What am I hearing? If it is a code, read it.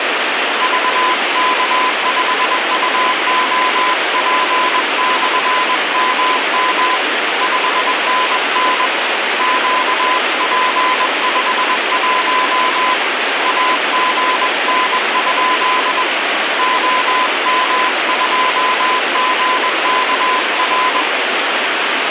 Morse code, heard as a keyed tone, hand-sent with a paddle, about 21 wpm, 1010 Hz, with heavy radio static. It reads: VK5UOP/MM 5NN QP51 AGN? OM2GKR